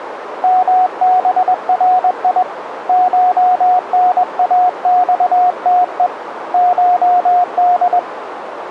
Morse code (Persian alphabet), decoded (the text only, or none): مبری شناخته شد